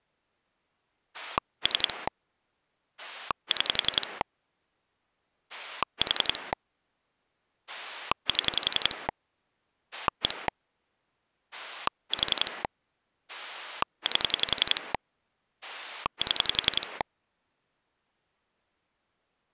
Pulse dialling, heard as a rotary dial, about 11 pulses a second. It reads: 3 6 4 7 1 4 8 7